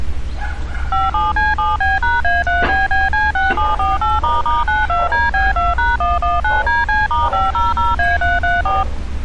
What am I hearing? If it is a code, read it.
DTMF, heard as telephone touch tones, dialled by machine, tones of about 180 ms, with street noise. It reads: 57C7B#A3BBC6748**92DB2#119DC*500A334